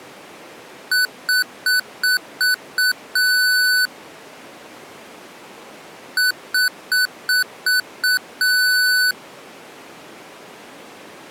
Beep code, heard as beeps from a small speaker, played twice, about 1500 Hz. 6 short, 1 long.